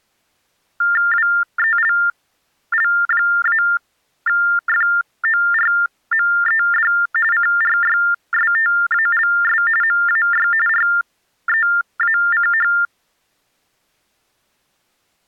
TTY/TDD text telephone tones (45.45 baud Baudot), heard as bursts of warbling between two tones, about 400 Hz shift, 1600 Hz centre. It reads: WELL-FORMED CRYSTALS MAY REACH